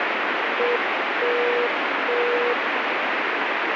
Morse code, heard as a keyed tone, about 8 wpm, 480 Hz, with heavy radio static. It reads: ETT